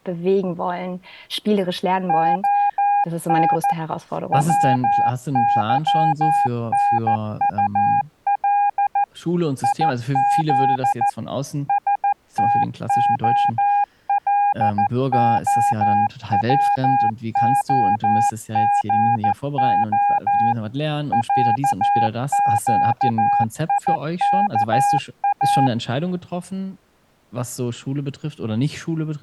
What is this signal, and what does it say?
Morse code (Russian alphabet), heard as a keyed tone, machine-sent, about 14 wpm, 810 Hz, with speech in German. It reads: ОН ВЫНУЛ ИЗ СТОЛОВОГО ЯЩИКА